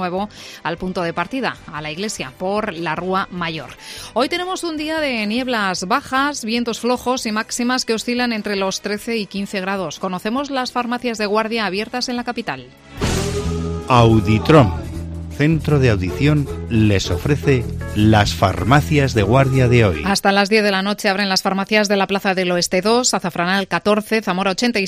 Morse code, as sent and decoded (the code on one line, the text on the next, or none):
none